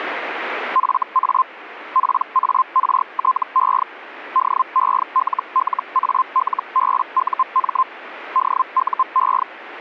Hellschreiber (Feld-Hell, 122.5 baud), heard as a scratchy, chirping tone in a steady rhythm, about 1040 Hz, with radio static. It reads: FA PARTE DELLALBUM DUE